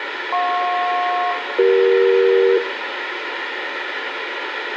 Aircraft SELCAL, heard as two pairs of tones, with radio hiss and room echo. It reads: JP-CE